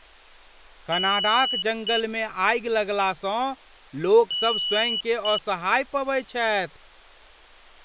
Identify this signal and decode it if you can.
Beep code, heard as a piezo beeper, played twice, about 2950 Hz, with speech in Maithili. 1 long, 1 short. In IBM BIOS tables: system board problem.